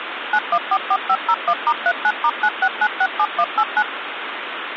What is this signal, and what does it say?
DTMF, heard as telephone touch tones, dialled by machine, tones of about 60 ms, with phone line noise. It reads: 9144501*39*96967189